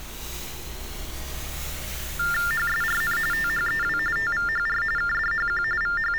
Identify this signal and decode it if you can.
TTY/TDD text telephone tones (45.45 baud Baudot), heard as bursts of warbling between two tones, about 400 Hz shift, 1600 Hz centre, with street noise. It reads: HSRN THEW TVHR KDHQ …